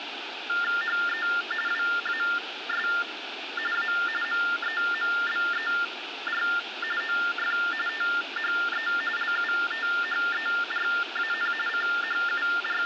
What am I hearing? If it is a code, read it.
TTY/TDD text telephone tones (45.45 baud Baudot), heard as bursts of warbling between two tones, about 400 Hz shift, 1600 Hz centre, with phone line noise. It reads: HE WAS A MEMBER OF THE LUTHERAN …